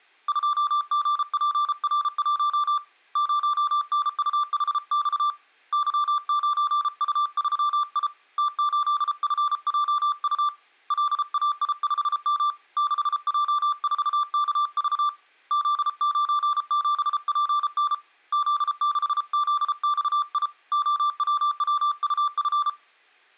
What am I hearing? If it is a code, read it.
Morse code, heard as a keyed tone, hand-sent with a paddle, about 33 wpm, 1180 Hz. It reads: 2GPR1 0NUHX Y9U3I T8FJU LAI5M 6J4KV Z97PN Z6ZXI OWWUF